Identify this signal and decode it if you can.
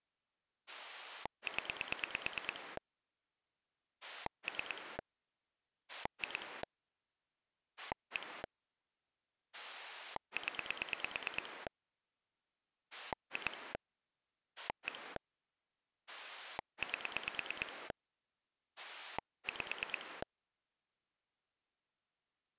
Pulse dialling, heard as a rotary dial, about 9 pulses a second. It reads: 0 3 2 1 0 2 1 8 5